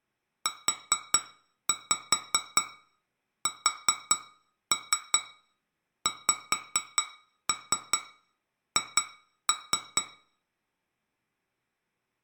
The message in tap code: USXH

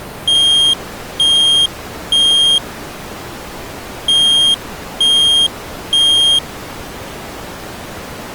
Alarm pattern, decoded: temporal three

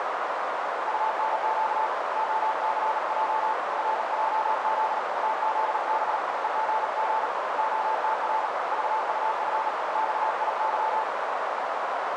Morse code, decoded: UNQ OCJ RJZ TZB EGG OTR VUF XIY

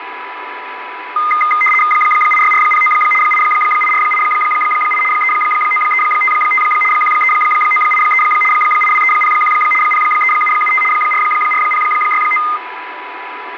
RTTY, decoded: 86409 88488 39355 13983 82301 03775 44069

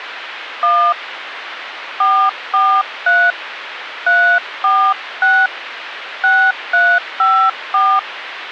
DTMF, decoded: 1 443 346 6354

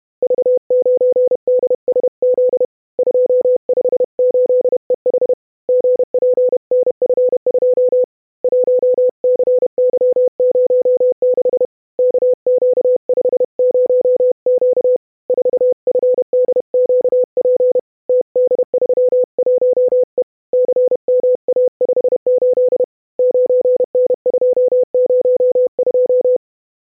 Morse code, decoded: V9DSZ 258EH GPNF2 1CY06 KQ50Q 4FDQP TD31E CMA58 9N202

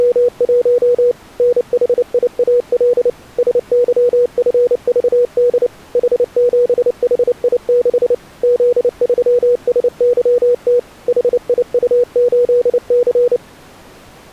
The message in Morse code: … NHIAL SYFVD H7HI6 Z3SYT HIU8C

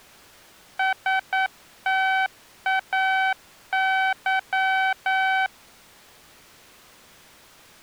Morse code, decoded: STAY

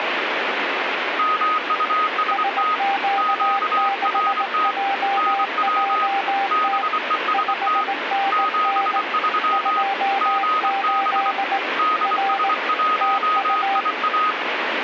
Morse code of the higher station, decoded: MUST QRT NW BEST 73 GB DS1IA

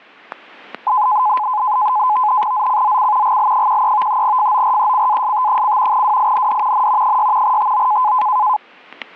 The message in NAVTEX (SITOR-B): ZCZC GL13 FORECAST: WIND N 6 TO

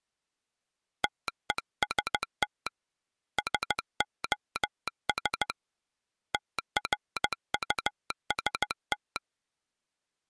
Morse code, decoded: TEST SOS TRUST

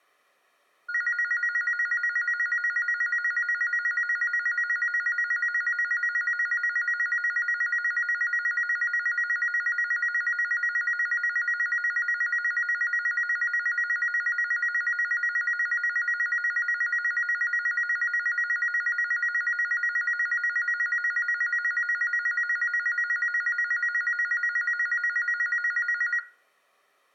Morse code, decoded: none

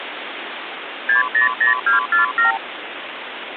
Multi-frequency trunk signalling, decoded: 600247

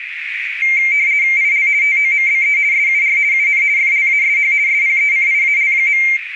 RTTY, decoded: IL TOMBE SUR UN FLASH SPECIAL.

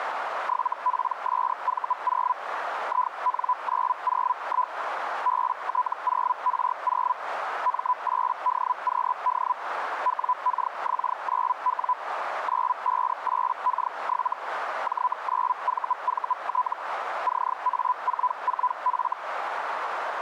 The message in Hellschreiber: 7PSV0 IN901 BT0R0 M8DQD WKX9W 958K7 J9VVT CA44F

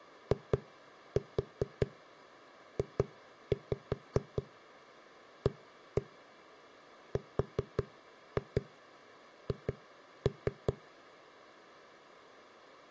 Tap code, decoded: IJARH

